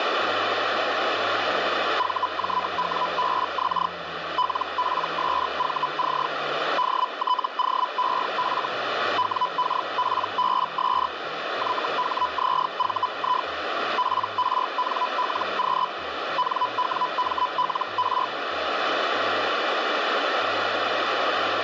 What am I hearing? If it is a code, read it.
Hellschreiber (Feld-Hell, 122.5 baud), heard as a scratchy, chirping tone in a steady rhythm, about 1000 Hz, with radio static. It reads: VJWBX LPSVC DTOEF WKPBS YHZVI PRNLQ NWMLR